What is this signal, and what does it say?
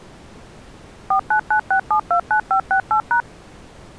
DTMF, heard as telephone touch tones, dialled by machine, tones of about 90 ms. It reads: 4996729568#